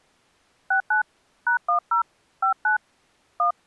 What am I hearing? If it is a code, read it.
DTMF, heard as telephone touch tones, dialled by hand, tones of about 110 ms. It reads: 69 #10 59 1